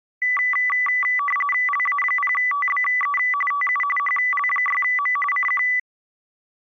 RTTY (45.45 baud, 850 Hz shift), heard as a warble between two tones, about 1550 Hz centre. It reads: LA0TBE TU HL6M CQ